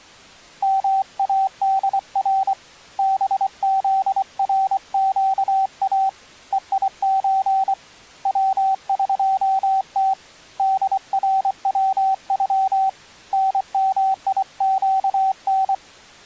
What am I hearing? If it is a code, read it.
Morse code (Persian alphabet), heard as a keyed tone, hand-sent with a paddle, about 24 wpm, 770 Hz. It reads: مادر بزرگا هیچ وقت دروغ نمیگن